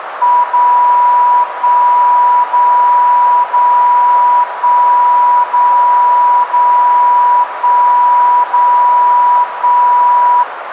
Radio time signal (DCF77), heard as a tone whose level steps once a second, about 980 Hz, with radio static and a narrow filter. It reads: 0 1 0 0 1 0 0 1 0 1